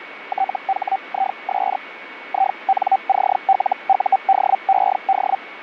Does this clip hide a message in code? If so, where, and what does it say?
Yes: Hellschreiber (Feld-Hell, 122.5 baud) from 0.3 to 5.4 s, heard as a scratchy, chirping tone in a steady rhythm, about 770 Hz, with radio static and a steady whistle near 2230 Hz. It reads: THIS INCLUDED